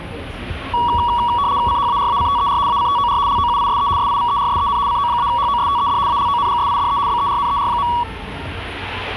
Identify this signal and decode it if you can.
RTTY (75 baud, 170 Hz shift), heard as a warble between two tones, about 1040 Hz centre, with the noise of a cafe. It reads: CHARACTER ACTOR LOUISE SIVERSEN CO-HOSTED ALONGSIDE BERNER.